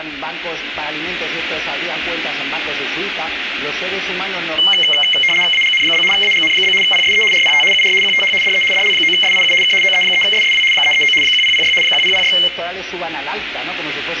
RTTY (75 baud, 850 Hz shift), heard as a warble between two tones, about 2550 Hz centre, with radio static and room echo. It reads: AGN? AGN? PSE RPT UR QTH DE DL9SIU K OE3SSW 339 1006 1006